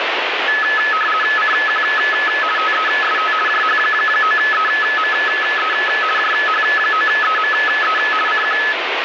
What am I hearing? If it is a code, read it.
RTTY (50 baud, 450 Hz shift), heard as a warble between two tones, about 1500 Hz centre, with radio static. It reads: CQ TEST JH9EME JH9EME CQ